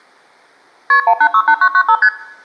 Multi-frequency trunk signalling (R1, as on North American trunks), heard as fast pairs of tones, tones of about 70 ms. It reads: KP 1868995 ST